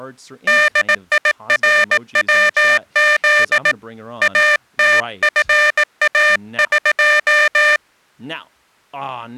Morse code (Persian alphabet), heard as a buzzer, hand-sent with a paddle, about 18 wpm, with speech in English. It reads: دیروز اتفاق